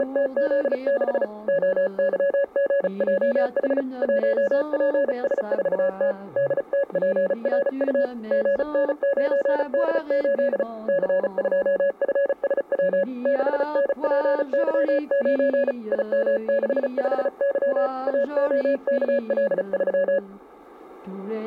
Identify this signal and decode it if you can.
Morse code, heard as a keyed tone, hand-sent with a paddle, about 35 wpm, 560 Hz, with static crashes. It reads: … OYGJH 1PS4T DTPRU GN9D8 C2FSW 6NPY9 IM65Y AOKL3